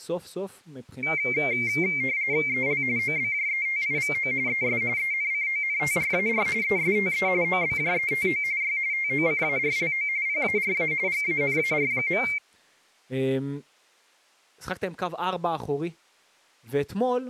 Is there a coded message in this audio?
Yes: RTTY (45.45 baud, 170 Hz shift) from 1.0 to 12.4 s, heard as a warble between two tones, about 2200 Hz centre, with speech in Hebrew. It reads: EL OBJETIVO ES ENCONTRAR ESTE OBJETO Y TOCARLO PARA GANAR.